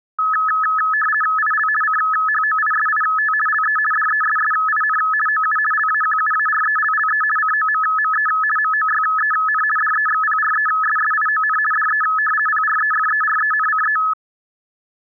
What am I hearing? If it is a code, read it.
RTTY (50 baud, 450 Hz shift), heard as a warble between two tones, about 1500 Hz centre. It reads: IL CHOISIT LE DESSIN OU LAQUARELLE COMME MOYEN DEXPRESSION DE PREFERENCE